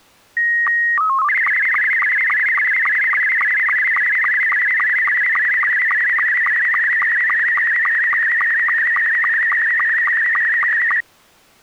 SSTV (slow-scan television), Scottie S2, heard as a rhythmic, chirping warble.